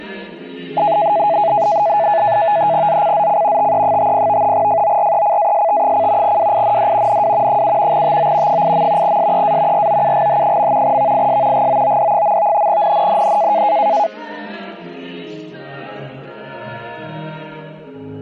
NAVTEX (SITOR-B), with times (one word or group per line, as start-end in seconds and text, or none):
2.9-3.7 ZCZC
3.6-4.5 TE50
4.5-6.4 FORECAST:
6.2-7.2 WIND
7.1-7.6 NW
7.5-8.0 7
7.9-8.6 TO
8.5-9.2 8.
9.0-9.9 SEA
9.7-11.0 ROUGH.
10.8-11.7 VIS
11.5-12.7 GOOD.
12.7-13.6 NNNN